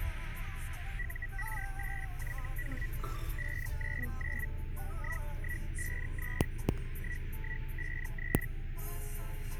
Hellschreiber (Feld-Hell, 122.5 baud), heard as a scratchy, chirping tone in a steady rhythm, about 1950 Hz, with radio static, a narrow filter and the noise inside a car. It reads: UR8YH 599 1153 1153